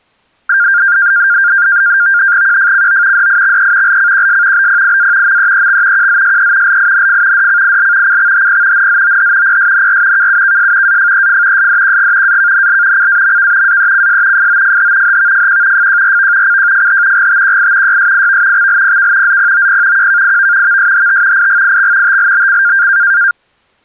NAVTEX (SITOR-B), 100 baud, 170 Hz shift, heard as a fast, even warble, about 1500 Hz centre. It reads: QFCO DIXE LCQS BPIA MEEX QZSE LINF DCIL CXHP NZOH PSNR KUKS AFEF SDQG AKNL CAMK AECS FOFH HVFQ FJRV CJFH GTQI YSIV XLPK ZPOP QKIV VSHT IGIX TLBC